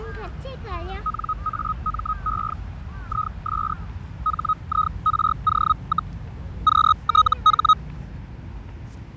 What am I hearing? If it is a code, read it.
Hellschreiber (Feld-Hell, 122.5 baud), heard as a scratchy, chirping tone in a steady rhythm, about 1260 Hz, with fading, static crashes and the noise of a residential street. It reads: NAME IS HIRO, QTH